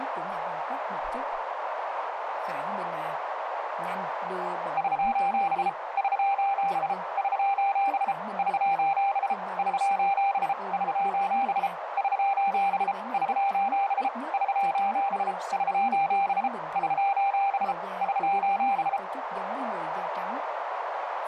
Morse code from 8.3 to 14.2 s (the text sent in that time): <SOS> <SOS> <SOS> <SOS> <SOS>